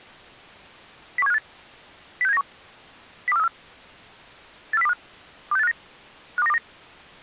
Five-tone selective call (EEA), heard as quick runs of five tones, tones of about 40 ms. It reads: 01758 06791 02434 84025 26859 52929